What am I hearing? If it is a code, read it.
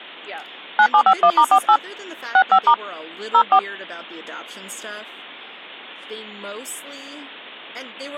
DTMF, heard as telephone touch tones, dialled by hand, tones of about 70 ms, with speech in English. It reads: 9751*48 65* 04